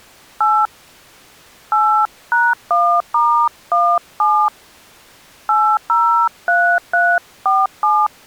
DTMF, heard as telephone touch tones, dialled by hand, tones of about 280 ms. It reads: 8 8#1*17 803347